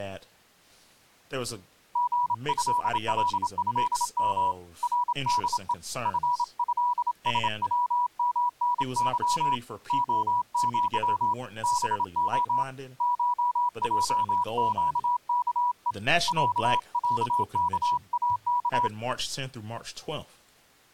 Morse code (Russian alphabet), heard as a keyed tone, hand-sent with a bug key, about 27 wpm, 980 Hz, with speech in English. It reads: ГЭЛЭМ РДЕ ФЭСВМНЫ ОЪ БО ШЙЩКЕ ЯЯКАК